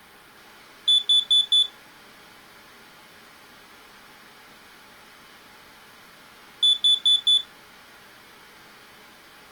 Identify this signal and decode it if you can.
Alarm pattern, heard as an alarm's beeps, played twice, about 3450 Hz. Temporal four. Carbon monoxide.